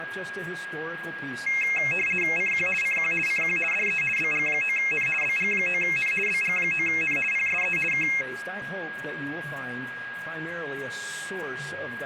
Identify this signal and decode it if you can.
RTTY (50 baud, 450 Hz shift), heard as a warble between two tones, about 2350 Hz centre, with a steady whistle near 1640 Hz. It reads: CQ CQ CQ DE BG9N BG9N BG9N PSE K